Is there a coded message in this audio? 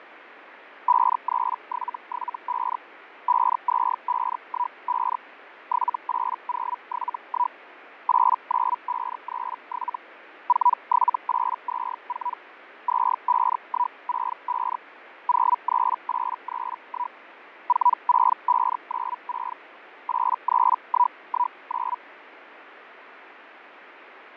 Yes: Hellschreiber (Feld-Hell, 122.5 baud) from 0.9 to 22.0 s, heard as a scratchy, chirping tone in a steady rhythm, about 980 Hz, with radio static and fading. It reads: 53775 52515 78071 89537 47824 25165 03831 46596 83119